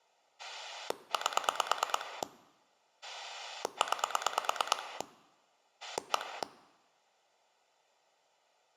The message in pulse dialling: 8 9 1

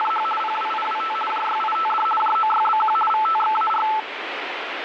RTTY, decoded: … PWIWT JYITD JOYBQ VTXAR

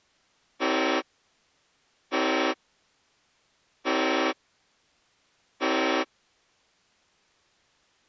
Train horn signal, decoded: 4 short

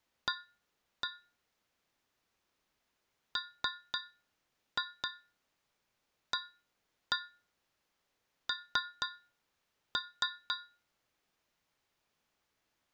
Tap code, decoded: A MAN

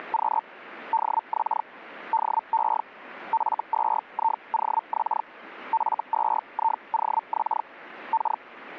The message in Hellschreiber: … DX DE F2IOX F2IOX K

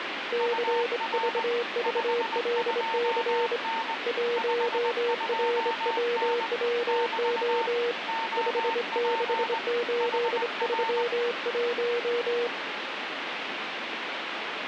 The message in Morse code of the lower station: CVVLC 1RWWO 56831

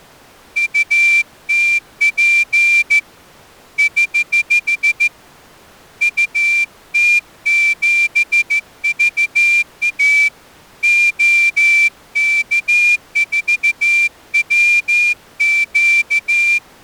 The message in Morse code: UTP <HH> UT7VA OK4WQ

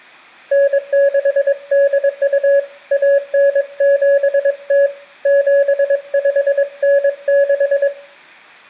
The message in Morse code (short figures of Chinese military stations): 9682 1970 7596

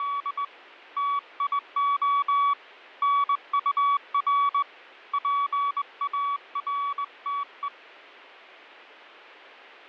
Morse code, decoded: … TIO NUR PARTE

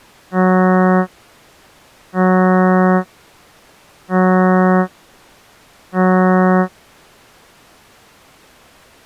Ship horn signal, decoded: 4 short

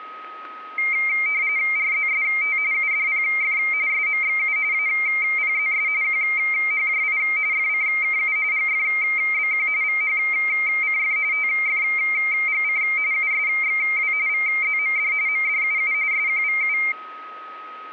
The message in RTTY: RZST UDPF SMXU APZS QHJI FCKU GFBQ VHCF TFGC USXW VZMD MDUU SQVU

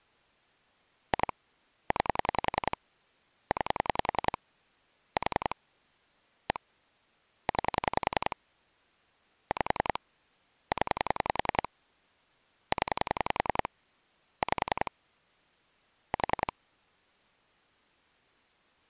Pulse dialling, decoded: 2 9 9 4 1 9 5 0 0 5 4

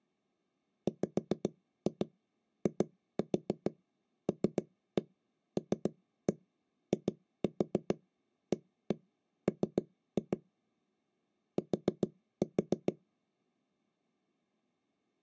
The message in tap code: WILLIAM T

